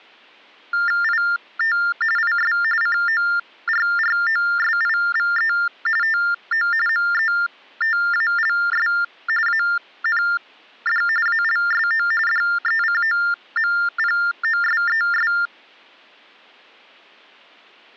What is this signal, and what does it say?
TTY/TDD text telephone tones (45.45 baud Baudot), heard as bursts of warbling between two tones, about 400 Hz shift, 1600 Hz centre. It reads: IT IS CORROSIVE TO METALS AND ALSO DECOMPOSES